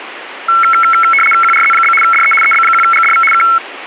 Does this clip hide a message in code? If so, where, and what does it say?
Yes: RTTY (75 baud, 850 Hz shift) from 0.5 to 3.6 s, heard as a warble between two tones, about 1750 Hz centre, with radio static. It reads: QRZ? DE EB1GDV K